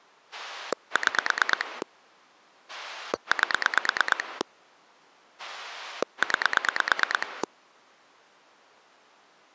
Pulse dialling, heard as a rotary dial, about 9 pulses a second. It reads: 6 8 9